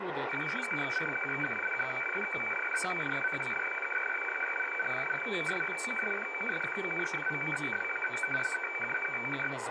Weather fax (radiofax), 120 lines a minute, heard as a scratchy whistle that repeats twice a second, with radio static, room echo and speech in Russian.